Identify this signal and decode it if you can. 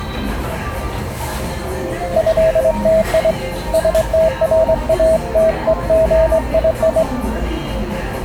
Morse code (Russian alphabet), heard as a keyed tone, hand-sent with a straight key, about 22 wpm, 640 Hz, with the noise of a cafe. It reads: ЭТИ СТРАТЕГИИ